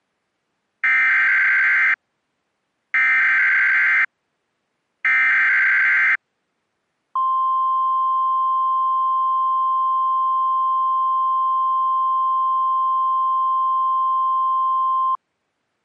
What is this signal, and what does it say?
Emergency Alert System (SAME) tones (header bursts, then the 1050 Hz attention tone), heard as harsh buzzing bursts, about 520.83 baud.